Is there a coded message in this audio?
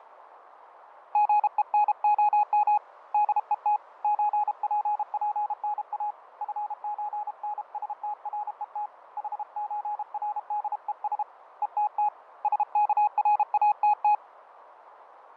Yes: Morse code (with Swedish letters) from 1.1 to 14.2 s, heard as a keyed tone, hand-sent with a paddle, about 32 wpm, 840 Hz, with radio static and fading. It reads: GENOM DET ÖPPNA FÖNSTRET HÖRDES ETT SKRATT